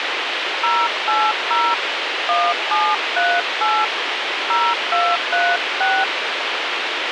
DTMF, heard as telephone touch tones, dialled by hand, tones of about 240 ms, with radio hiss. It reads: 080 1738 0236